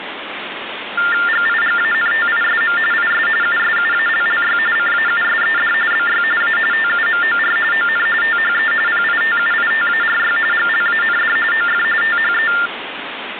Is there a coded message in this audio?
Yes: TTY/TDD text telephone tones (45.45 baud Baudot) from 1.0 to 12.7 s, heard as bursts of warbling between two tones, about 400 Hz shift, 1600 Hz centre, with phone line noise. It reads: GIGANTISM IS USUALLY CAUSED BY A TUMOR ON THE PITUITARY GLAND OF THE